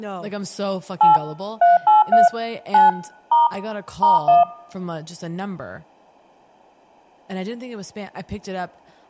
DTMF, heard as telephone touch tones, dialled by machine, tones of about 160 ms, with speech in English. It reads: 8 383 9 * *1